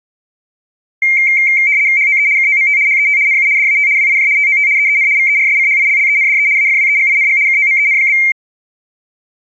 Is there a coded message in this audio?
Yes: RTTY (75 baud, 170 Hz shift) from 1.0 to 8.3 s, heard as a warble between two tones, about 2200 Hz centre. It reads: HOE KOMT HET NU DAT WIJ TOT EEN VERSCHILLENDE AFWEGING KOMEN?